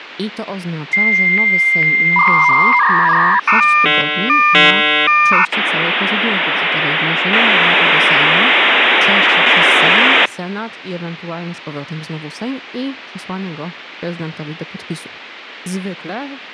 Dial-up modem handshake (V.34 or later), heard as a whistle, warbles, then hiss, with phone line noise and speech in Polish.